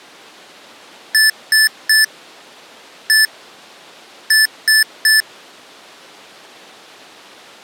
Beep code, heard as beeps from a small speaker, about 1750 Hz. 3-1-3. In Phoenix BIOS tables: interrupt mask register failure.